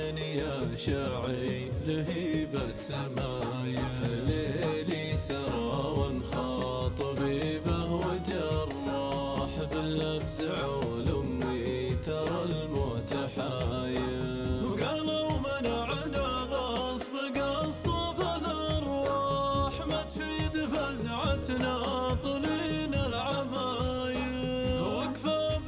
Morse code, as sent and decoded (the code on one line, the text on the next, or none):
none